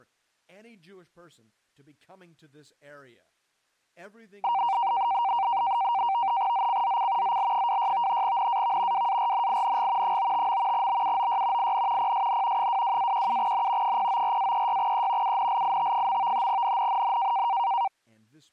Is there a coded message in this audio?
Yes: NAVTEX (SITOR-B), 100 baud, 170 Hz shift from 4.4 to 17.9 s, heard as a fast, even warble, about 860 Hz centre, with speech in English. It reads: ZCZC ZL26 NAV WARNING 95. BUOY IN PSN 22-17N 094-36E UNLIT. NNNN